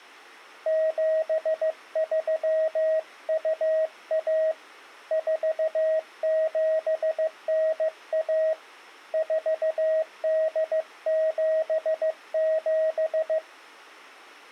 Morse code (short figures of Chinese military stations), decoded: 7321 4791 4877

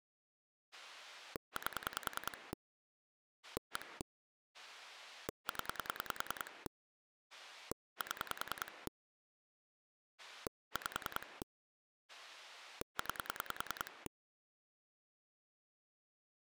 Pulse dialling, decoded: 8 1 0 7 5 9

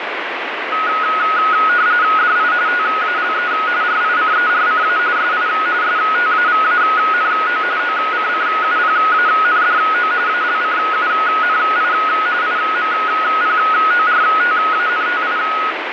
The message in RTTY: DI TALE RICERCA SI STAVANO OCCUPANDO ALCUNI IMPORTANTI

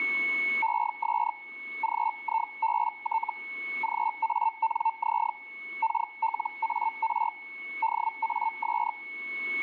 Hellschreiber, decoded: ES GIBT GANZ KLAR DAS

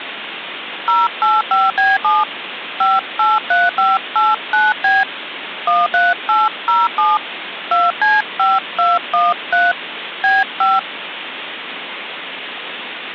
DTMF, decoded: 085B7 583589B 13807 2C5213 B5

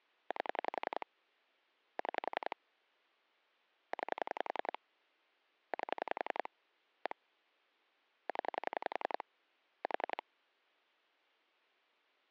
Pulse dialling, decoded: 8 6 9 8 1 0 4

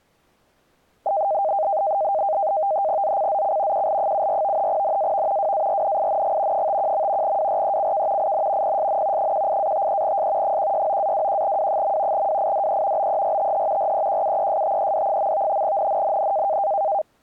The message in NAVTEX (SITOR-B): ZCZC QL74 NAV WARNING 51. WRECK IN PSN 18-53S 169-21W. WIDE BERTH REQUESTED. NNNN

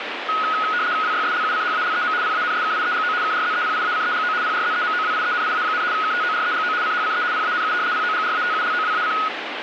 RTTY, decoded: WYSLUCHALEM PANSKIEGO KRZEPIACEGO PRZEMOWIENIA, KTOREGO CHCE PANU POGRATULOWAC

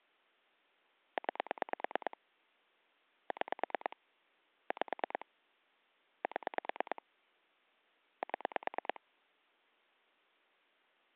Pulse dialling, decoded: 9 6 5 7 7

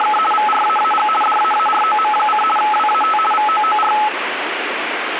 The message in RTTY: … VRAAG DAAROM: WAT VOOR

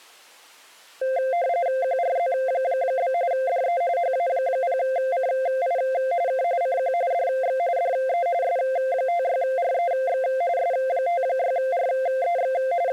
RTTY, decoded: QRZ? DE HA0CI K CQ DX DE S56REX S56REX …

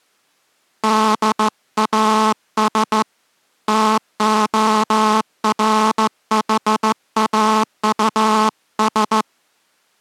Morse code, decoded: DAS TORHAUS

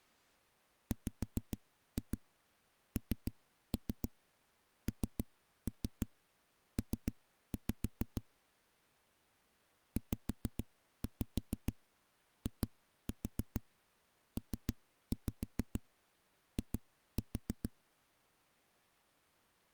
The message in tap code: WNNP ZIPI

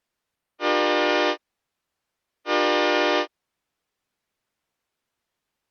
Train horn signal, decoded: 2 short

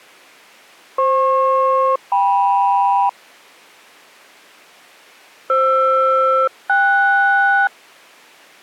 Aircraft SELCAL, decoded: FP-KM FR-KS

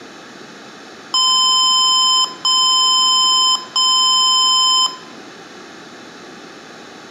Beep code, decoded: 3 long

